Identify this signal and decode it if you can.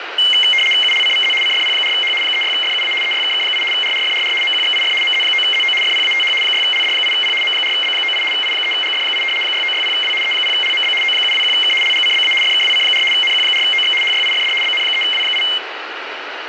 RTTY (75 baud, 850 Hz shift), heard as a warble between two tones, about 2550 Hz centre, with radio static. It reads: ULCVZ CFP4H 36FUA EYKK8 RRFRR MQXIF MZ9ZO FPATH 6LD8P M4B98 I3GF8 6960W E0LMB O721K LGCBA FKWC4 NQ4OX HYIFD BN3W8